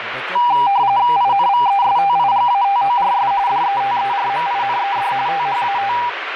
RTTY (45.45 baud, 170 Hz shift), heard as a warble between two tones, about 880 Hz centre, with radio static and speech in Punjabi. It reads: INVESTIGATORS DETERMINED THAT